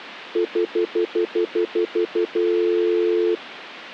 Telephone call progress tone (North American plan), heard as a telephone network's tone, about 350, 440 Hz, 0.1 s on and 0.1 s off. Stutter dial tone.